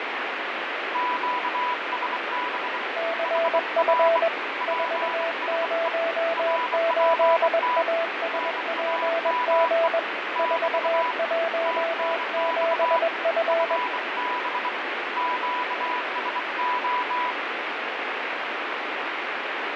Morse code, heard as two keyed tones, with heavy radio static and fading. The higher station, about 24 wpm, 990 Hz: QSB HR PSE RPT NAME <BT> TNX FB QSO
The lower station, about 21 wpm, 660 Hz: CF 408ASPG 417F